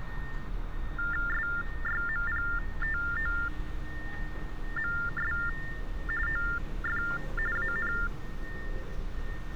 TTY/TDD text telephone tones (45.45 baud Baudot), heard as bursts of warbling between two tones, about 400 Hz shift, 1600 Hz centre, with street noise. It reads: SYMPTOMS OF AN